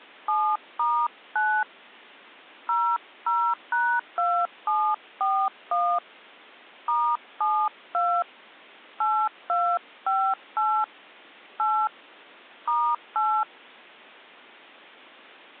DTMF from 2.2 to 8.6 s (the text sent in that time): 00#2741 *72